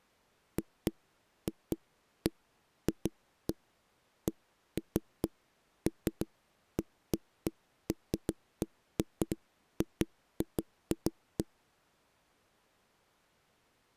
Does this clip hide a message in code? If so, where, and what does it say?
No, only irregular knocks on a wall.